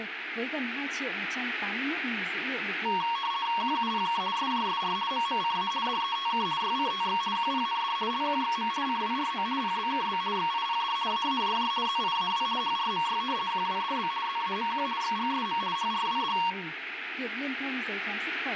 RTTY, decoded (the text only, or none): QUPK SJSR MMCA DETK YCTX QPND LQXM CWRO PBKB XIPD AAJJ ZIAW HRMY QWDB ZAMQ XGSM HRWD